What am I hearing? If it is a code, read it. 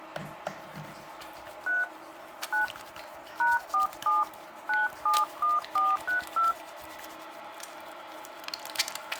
DTMF, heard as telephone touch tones, dialled by hand, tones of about 160 ms, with the noise of a restroom. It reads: 3 9 #47 971432